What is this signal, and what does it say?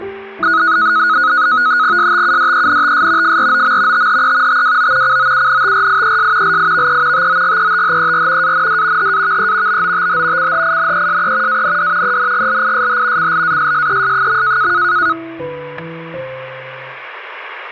NAVTEX (SITOR-B), 100 baud, 170 Hz shift, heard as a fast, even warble, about 1360 Hz centre, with static crashes. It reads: STUDENTS FROM THE TWO COUNTRIES LIVE TOGETHER AND HAVE BOTH CHINESE AND ENGLISH CLASSES.